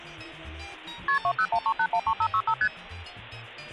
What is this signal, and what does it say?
Multi-frequency trunk signalling (R1, as on North American trunks), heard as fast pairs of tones, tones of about 70 ms. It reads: KP 2013813565 ST